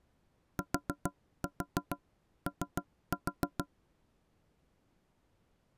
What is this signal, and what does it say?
Tap code, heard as knocks on wood, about 6 knocks a second. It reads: TO